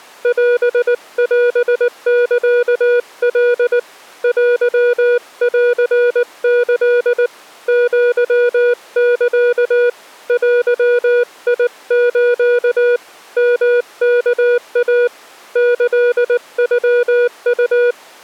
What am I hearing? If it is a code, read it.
Morse code (Japanese Wabun code), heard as a keyed tone, hand-sent with a paddle, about 19 wpm, 480 Hz. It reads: オオサカ テンキ アサ デス ヨワイ キノウ